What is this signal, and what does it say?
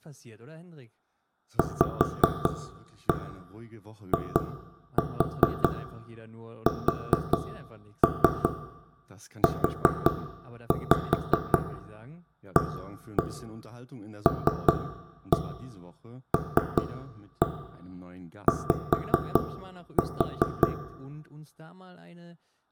Tap code, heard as knocks on wood, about 5 knocks a second, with room echo and speech in German. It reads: VISUALLY